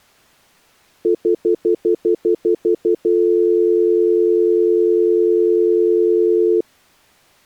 Telephone call progress tone (North American plan), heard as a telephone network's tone, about 350, 440 Hz, 0.1 s on and 0.1 s off. Stutter dial tone.